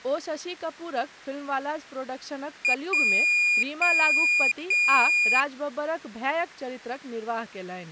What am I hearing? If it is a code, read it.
Beep code, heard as a piezo beeper, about 2450 Hz, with speech in Maithili. 1 short, 3 long.